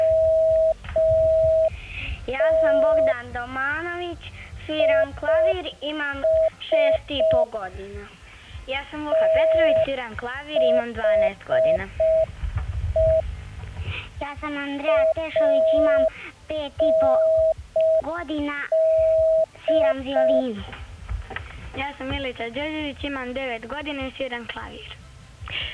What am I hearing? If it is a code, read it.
Morse code, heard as a keyed tone, machine-sent, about 5 wpm, 640 Hz. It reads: … IS THE AND